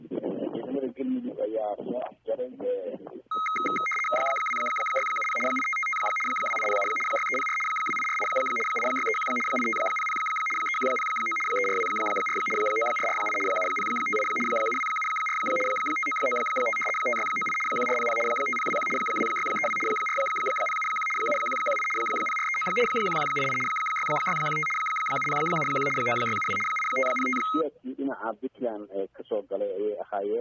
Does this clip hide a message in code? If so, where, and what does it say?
Yes: RTTY (75 baud, 850 Hz shift) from 3.3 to 27.6 s, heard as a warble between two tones, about 1700 Hz centre. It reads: 2670 8555 2807 6304 2848 8631 8500 3109 3424 9448 7058 7274 5995 5698 1400 5021 2632 4071 7118 0439 1188 6615 7071 9672 8505